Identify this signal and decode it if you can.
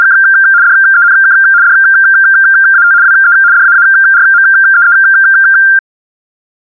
RTTY (75 baud, 170 Hz shift), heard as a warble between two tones, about 1490 Hz centre. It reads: … DENK DAT WE DAARMEE